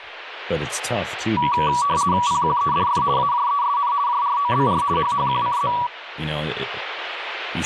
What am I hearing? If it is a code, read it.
RTTY (50 baud, 170 Hz shift), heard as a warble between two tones, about 1050 Hz centre, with radio static and speech in English. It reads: PQEDF AJESN JROBR HHQCZ